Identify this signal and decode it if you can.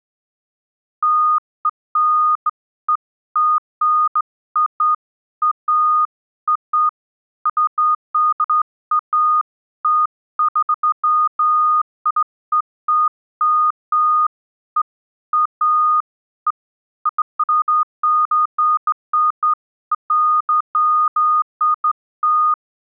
Beeps of irregular length. There is no code.